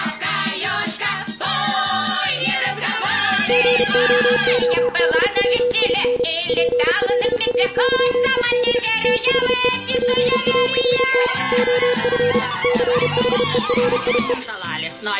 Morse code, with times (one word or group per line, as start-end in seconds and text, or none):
3.5-6.2 GOODWIN
6.5-8.8 PLAYED
9.0-9.7 THE
9.9-11.3 PART
11.5-12.4 OF
12.6-14.3 CHERIE